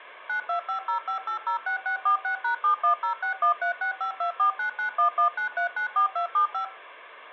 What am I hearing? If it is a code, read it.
DTMF, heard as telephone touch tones, dialled by machine, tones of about 110 ms. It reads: 92505806646#710613652499119394275